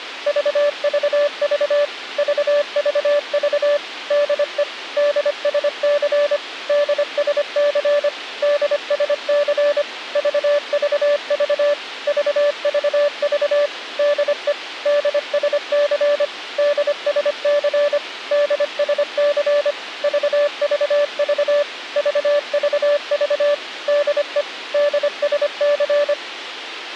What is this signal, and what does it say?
Morse code, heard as a keyed tone, machine-sent, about 25 wpm, 580 Hz, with a squelch burst at the end. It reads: VVV VVV DE DSC DSC DSC VVV VVV DE DSC DSC DSC VVV VVV DE DSC